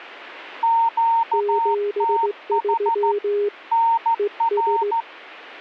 Morse code, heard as two keyed tones. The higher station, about 14 wpm, 920 Hz: QTH NR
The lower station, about 17 wpm, 410 Hz: 73 ES